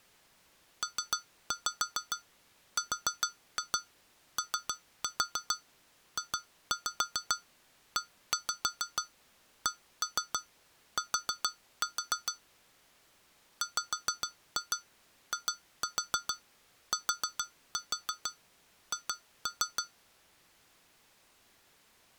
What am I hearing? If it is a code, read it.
Tap code, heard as taps on glass, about 6 knocks a second. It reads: PROJECT WITH